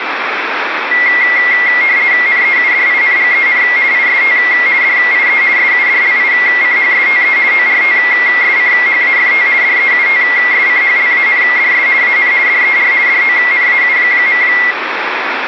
RTTY (50 baud, 170 Hz shift), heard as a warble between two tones, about 2050 Hz centre, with radio static. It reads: NEUDINGEN IST DIE SUDLICHSTE ORTSCHAFT DEUTSCHLANDS AN DER DONAU.